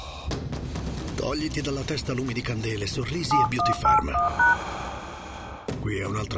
DTMF, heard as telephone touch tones, dialled by hand, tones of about 140 ms. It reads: 7181#